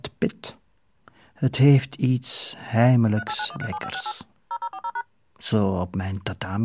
DTMF, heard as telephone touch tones, dialled by machine, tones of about 60 ms, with speech in Dutch. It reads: 389137568 0040#